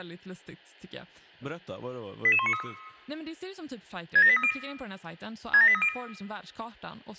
Five-tone selective call (ZVEI), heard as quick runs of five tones, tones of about 70 ms, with speech in Swedish. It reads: 88193 67830 67830